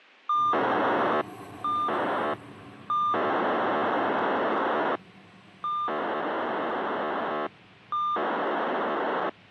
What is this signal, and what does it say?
POCSAG pager data (2400 baud), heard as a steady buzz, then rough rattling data, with street noise.